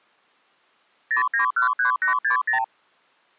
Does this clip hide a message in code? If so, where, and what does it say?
Yes: multi-frequency trunk signalling (R2, with the far end's replies) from 1.1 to 2.6 s, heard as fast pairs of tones, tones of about 110 ms. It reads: 0913860